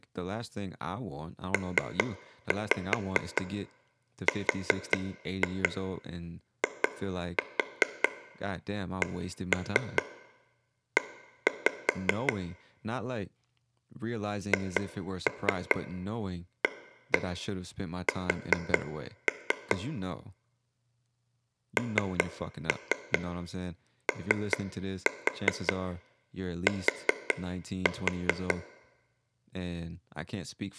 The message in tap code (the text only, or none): PRICE HAS NOT